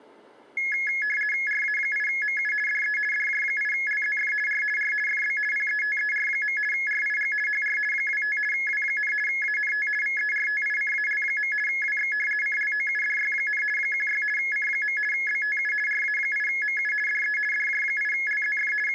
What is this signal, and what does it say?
RTTY (50 baud, 450 Hz shift), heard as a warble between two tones, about 1900 Hz centre. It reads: RA8MU DE DJ8LZF R R FB PETER. RIG HR 25 W, ANT VERTICAL. WX CLOUDY, 16 C. BTU RA8MU DE DJ8LZF …